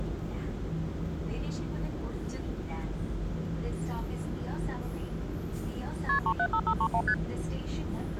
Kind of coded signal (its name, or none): multi-frequency trunk signalling